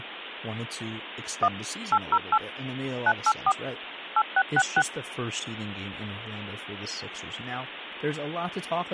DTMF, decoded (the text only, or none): 1 808 984 8666